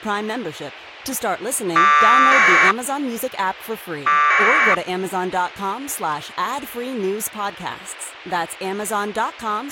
Packet radio (AX.25, as in APRS), 1200 baud, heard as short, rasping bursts, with speech in English.